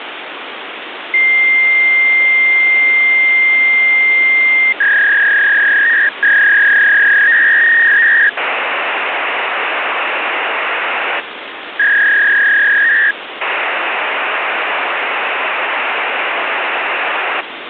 Fax machine handshake, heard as a long tone, a warble and hiss, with phone line noise.